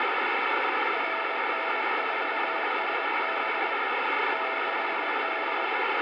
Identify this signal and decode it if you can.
Morse code, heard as a keyed tone, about 22 wpm, 660 Hz, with radio static and room echo. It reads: RN4SB 6D